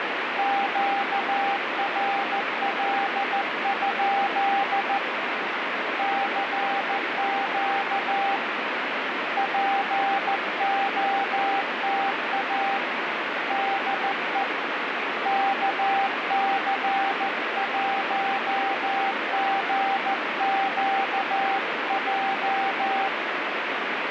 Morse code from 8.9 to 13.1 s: POTA

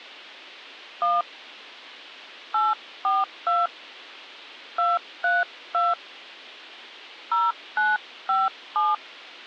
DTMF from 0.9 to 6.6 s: 1 842 232

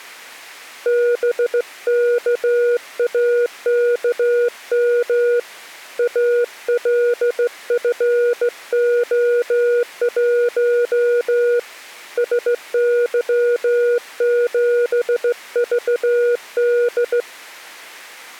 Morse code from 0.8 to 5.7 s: BKAKM

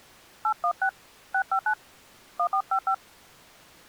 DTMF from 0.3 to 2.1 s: 816 659

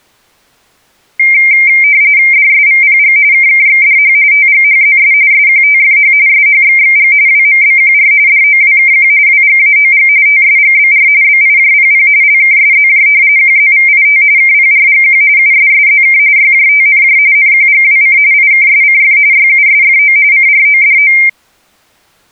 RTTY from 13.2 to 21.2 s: QZVIT KPRGQ USSZK YJTNJ NQGWC IKSCF YUSFO CRODO

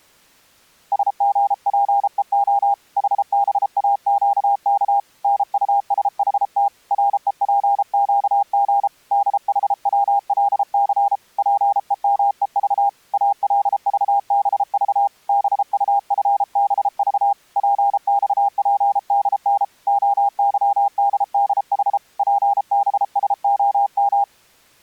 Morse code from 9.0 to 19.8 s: DHWLC PEMEV ALVBV BUFBV PXPDN

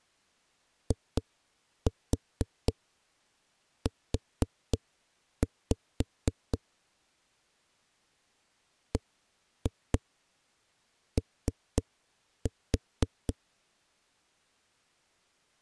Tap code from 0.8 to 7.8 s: IU

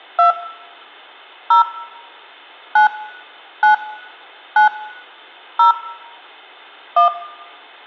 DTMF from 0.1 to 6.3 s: 2 0 9 9 9 0

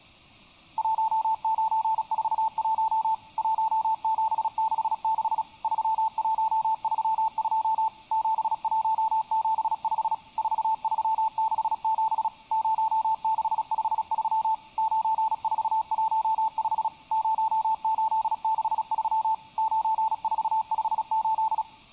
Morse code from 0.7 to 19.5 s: 1941 1766 3132 7175 4367 0653 9415 0863

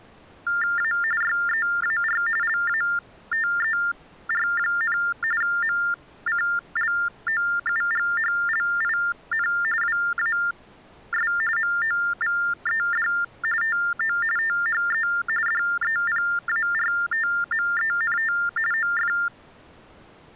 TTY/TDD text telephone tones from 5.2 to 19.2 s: MCLOUGHLIN WAS MOVED TO THE DEPARTMENT OF

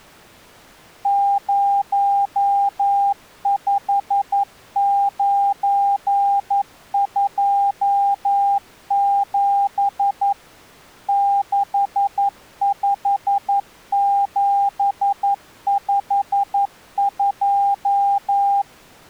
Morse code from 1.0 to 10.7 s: 05927

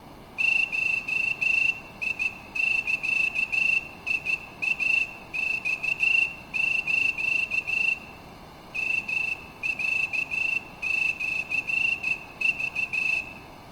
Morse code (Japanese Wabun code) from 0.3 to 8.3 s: ゴザイマス

